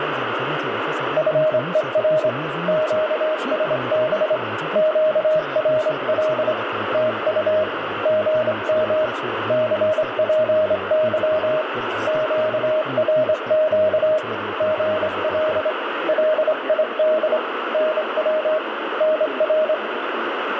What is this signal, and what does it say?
Morse code, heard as a keyed tone, hand-sent with a straight key, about 25 wpm, 620 Hz, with radio static. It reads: FER QSB QRL TU GM CPY QRQ GL LID NW NR